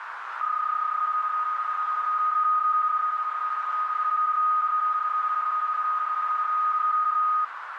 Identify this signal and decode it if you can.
PSK31 (31.25 baud), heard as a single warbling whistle, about 1240 Hz, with radio static and a narrow filter.